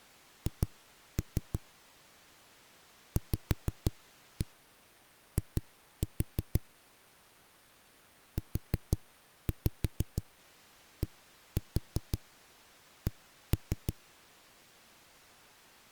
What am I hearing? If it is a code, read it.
Tap code, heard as knocks on a wall, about 6 knocks a second. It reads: H VI UDC